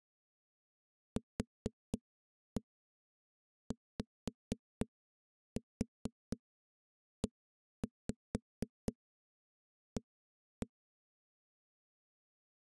Tap code, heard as knocks on a wall, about 4 knocks a second. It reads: QYEA